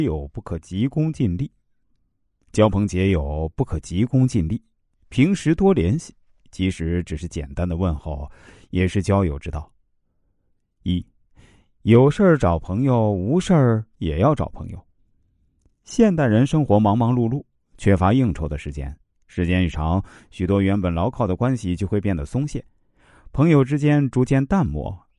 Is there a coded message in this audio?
No, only speech in Chinese.